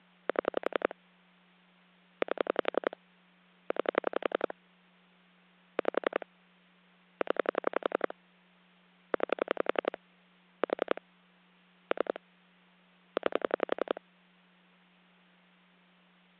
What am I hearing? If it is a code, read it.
Pulse dialling, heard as clicks on a phone line, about 11 pulses a second, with hum. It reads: 7 8 9 5 0 9 4 3 9